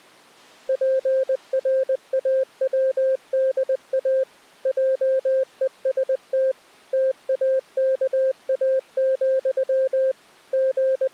Morse code, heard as a keyed tone, machine-sent, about 20 wpm, 530 Hz. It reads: PRAWDA JEST TAKA, …